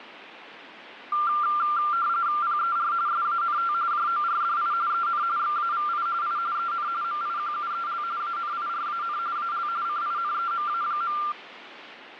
RTTY (45.45 baud, 170 Hz shift), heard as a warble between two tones, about 1280 Hz centre, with radio static. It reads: PER SANT JORDI EN XAVI I EN MIQUEL ANIRAN AL CINEMA.